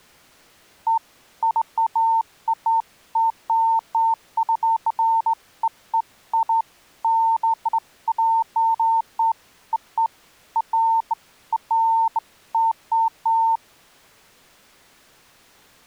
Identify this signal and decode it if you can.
Beeps of irregular length. There is no code.